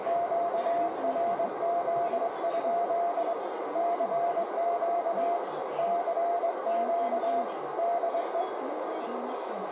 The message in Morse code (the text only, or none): QRZ? CQ CQ DE